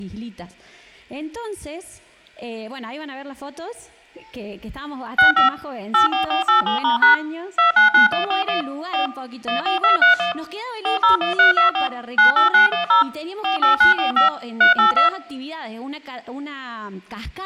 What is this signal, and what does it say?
DTMF, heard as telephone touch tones, dialled by machine, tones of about 130 ms. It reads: 65 84487*# 299141 4 14231 401324 98910 48945 382